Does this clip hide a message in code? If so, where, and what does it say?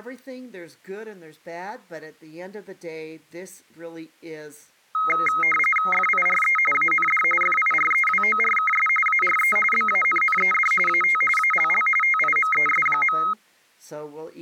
Yes: RTTY (45.45 baud, 850 Hz shift) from 4.9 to 13.3 s, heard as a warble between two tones, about 1700 Hz centre, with speech in English. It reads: FIRE AND FIREWORKS ARE BANNED AT ALL TIMES.